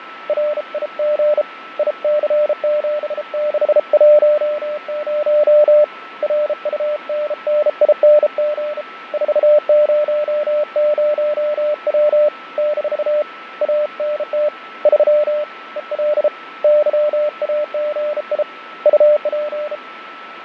Morse code, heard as a keyed tone, hand-sent with a bug key, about 33 wpm, 600 Hz, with radio static, fading and a steady whistle near 1320 Hz. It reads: RIG IC7610 RUNNING 400W - ANT 3 EL YAGI UP